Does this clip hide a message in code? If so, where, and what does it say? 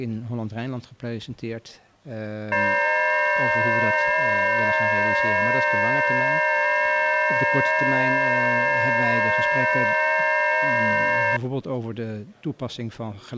Yes: FT8 (several signals at once) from 2.5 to 11.4 s, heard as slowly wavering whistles, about 6.25 baud.